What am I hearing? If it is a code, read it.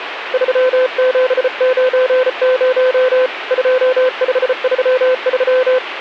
Morse code, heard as a keyed tone, hand-sent with a bug key, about 34 wpm, 510 Hz, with radio static. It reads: 3790 2533